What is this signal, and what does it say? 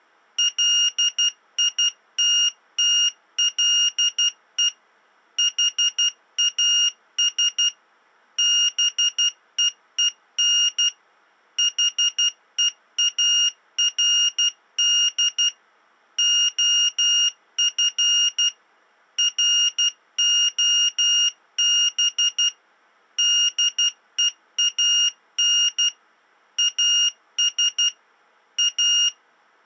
Morse code, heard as a high beeper, machine-sent, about 12 wpm, 2850 Hz. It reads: LITTLE HAS BEEN HEARD OF ROB DEAN AS A